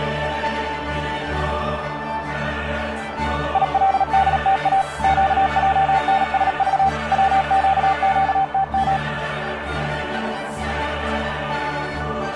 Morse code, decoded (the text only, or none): ILDTA QJNSV WQQTM